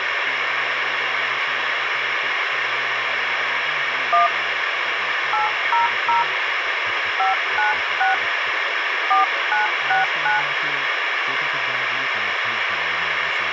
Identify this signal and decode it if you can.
DTMF, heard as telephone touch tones, dialled by hand, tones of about 140 ms, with radio hiss and a squelch burst at the end. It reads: 1 800 596 4969